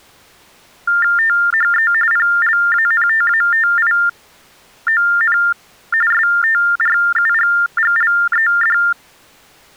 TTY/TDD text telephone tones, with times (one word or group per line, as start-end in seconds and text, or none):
1.2-1.9 THE
2.1-5.4 PLANTATION
6.1-8.8 STRUGGLED